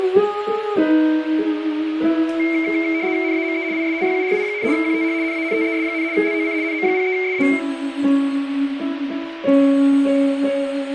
RTTY (75 baud, 170 Hz shift), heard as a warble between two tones, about 2200 Hz centre, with radio static and a steady whistle near 590 Hz. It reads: NAME IS YURI, QTH NANTES, LOC NM03SA